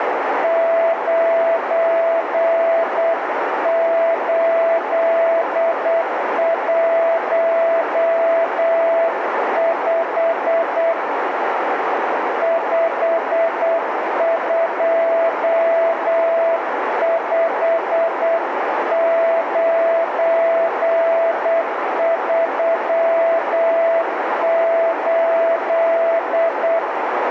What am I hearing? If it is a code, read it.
Morse code, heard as a keyed tone, hand-sent with a paddle, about 8 wpm, 660 Hz, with radio static and a narrow filter. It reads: 9815 525938